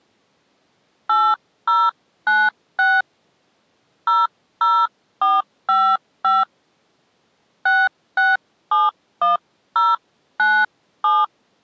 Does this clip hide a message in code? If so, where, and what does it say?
Yes: DTMF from 1.1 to 11.2 s, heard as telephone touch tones, dialled by hand, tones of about 200 ms. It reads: 8096 00455 6671097